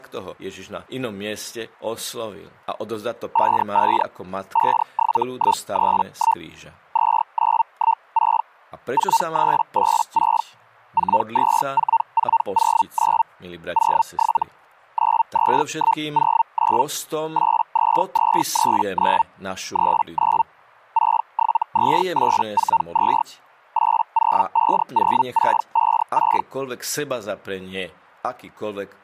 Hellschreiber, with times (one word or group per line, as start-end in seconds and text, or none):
3.3-4.0 55
4.5-6.4 57131
6.9-8.4 2916
8.9-10.4 4386
10.9-13.2 424409
13.7-14.4 07
14.9-16.8 92109
17.3-19.2 82239
19.7-20.4 39
20.9-23.2 672842
23.7-26.4 8050656